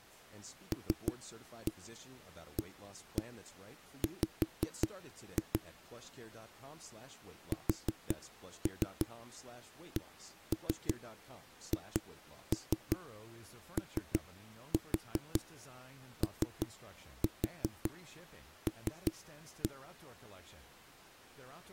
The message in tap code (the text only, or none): LAW SCHOOL